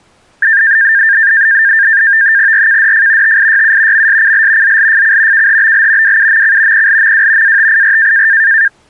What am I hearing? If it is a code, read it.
NAVTEX (SITOR-B), 100 baud, 170 Hz shift, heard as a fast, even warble, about 1700 Hz centre. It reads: RKDF TIYU MSCL ZLFC KHBL WUMC PLMW ATIR